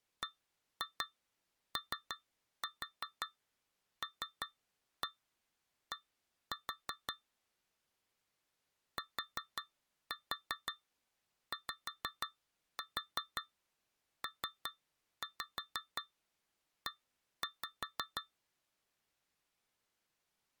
Tap code, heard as taps on a metal pipe, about 5 knocks a second. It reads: BOLD TYPE